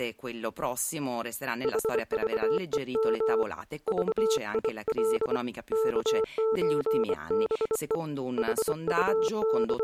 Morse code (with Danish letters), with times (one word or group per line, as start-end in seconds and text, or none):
1.6-3.4 HVEM
3.9-5.4 VIL
5.7-8.0 KØBE
8.4-9.8 …